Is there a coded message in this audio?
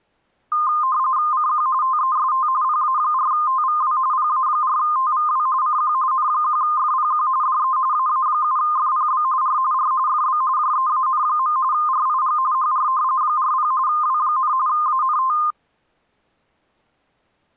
Yes: RTTY (45.45 baud, 170 Hz shift) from 0.5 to 15.5 s, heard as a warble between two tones, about 1140 Hz centre. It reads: CQ TEST PA4TVW PA4TVW CQ N1FPQ DE AA7FPB R R FB JEAN. RIG HR 40 W, ANT